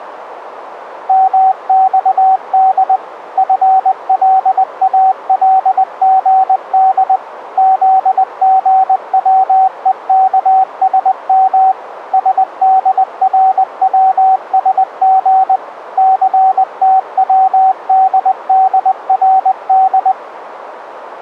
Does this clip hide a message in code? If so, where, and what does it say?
Yes: Morse code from 1.0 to 20.2 s, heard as a keyed tone, machine-sent, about 20 wpm, 760 Hz, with radio static. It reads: MXD FLALGD ZGWEKSM SDRWSG CTWDDRD